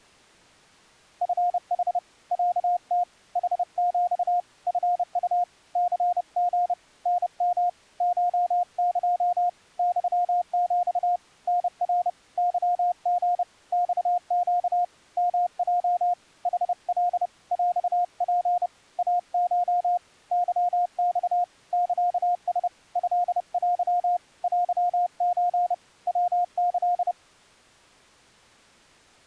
Morse code (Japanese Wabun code), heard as a keyed tone, hand-sent with a paddle, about 30 wpm, 710 Hz. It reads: チヌ ロム ヌヒ チウ ニリ タヨ コエ ユヒ タナ ケリ マネ ヨヲ ヌカ ヰツ イコ ケマ サラ トテ テソ ヤキ